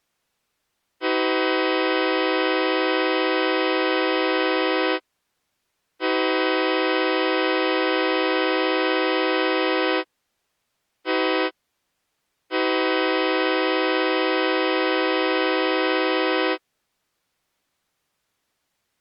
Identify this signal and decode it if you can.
Train horn signal, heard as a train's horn. 2 long, 1 short, 1 long. On North American railways: approaching a public crossing.